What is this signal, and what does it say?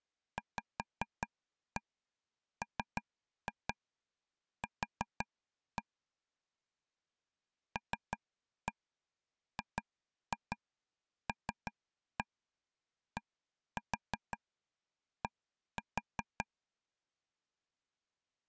Tap code, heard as taps on a table, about 5 knocks a second. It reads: VMQ LGLDD